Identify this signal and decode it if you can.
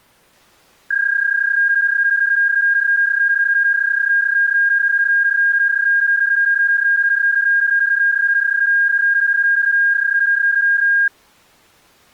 PSK31 (31.25 baud), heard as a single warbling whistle, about 1600 Hz.